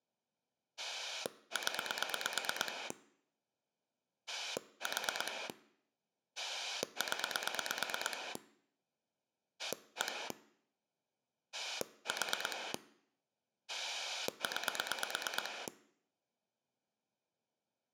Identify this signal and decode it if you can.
Pulse dialling, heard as a rotary dial, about 8 pulses a second. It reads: 0 4 0 1 4 9